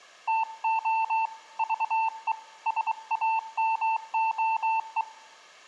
Morse code (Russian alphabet), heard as a keyed tone, hand-sent with a bug key, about 23 wpm, 890 Hz, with room echo. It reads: ТО ЖЕ САМОЕ